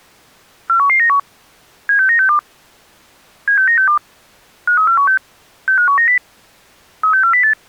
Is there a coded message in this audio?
Yes: five-tone selective call (CCIR) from 0.7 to 7.5 s, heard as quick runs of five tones, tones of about 100 ms. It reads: 41191 76962 76962 53416 65190 36408